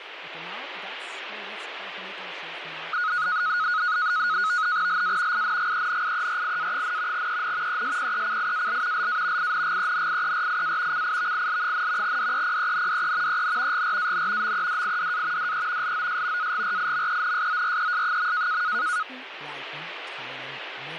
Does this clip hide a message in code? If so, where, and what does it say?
Yes: NAVTEX (SITOR-B), 100 baud, 170 Hz shift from 2.9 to 19.0 s, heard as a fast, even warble, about 1360 Hz centre, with radio static. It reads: LA INGENIERIA, EN ESPECIAL LA INGENIERIA CIVIL, DEPENDE EN GRAN MEDIDA DE LOS AGRIMENSORES.